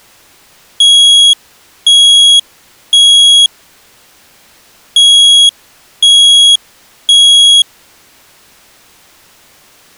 Alarm pattern, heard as an alarm's beeps, played twice, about 3300 Hz. Temporal three. Smoke or fire, evacuate.